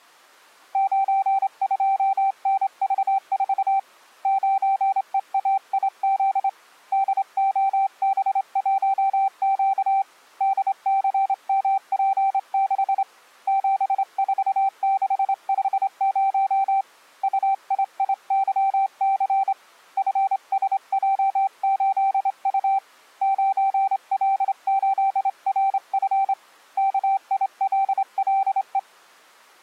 Morse code, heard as a keyed tone, hand-sent with a straight key, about 27 wpm, 780 Hz. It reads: 92NV4 9EAIZ DOB1Q DCMP6 74650 UIIYC FSJ8U 9L8RF KILLE